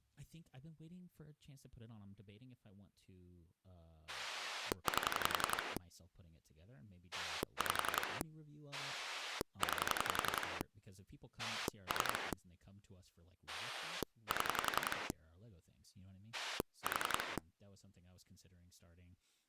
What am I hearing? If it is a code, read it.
Pulse dialling, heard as a rotary dial, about 11 pulses a second, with speech in English. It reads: 8 5 9 3 7 4